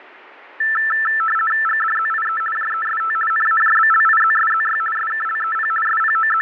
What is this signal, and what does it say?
RTTY (50 baud, 450 Hz shift), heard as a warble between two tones, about 1550 Hz centre, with fading. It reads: GDZIE JEST NAJBLIZSZY SKLEP …